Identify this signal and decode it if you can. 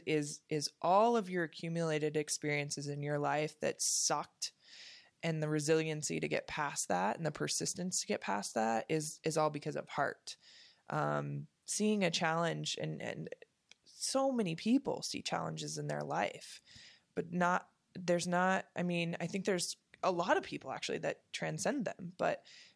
Speech in English. There is no code.